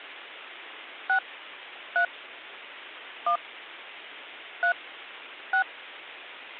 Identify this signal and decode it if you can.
DTMF, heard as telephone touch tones, dialled by hand, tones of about 90 ms. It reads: 6 3 1 3 6